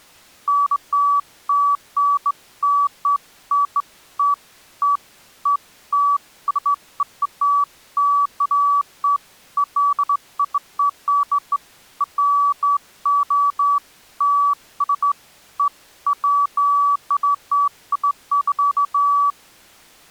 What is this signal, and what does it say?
Beeps of irregular length. There is no code.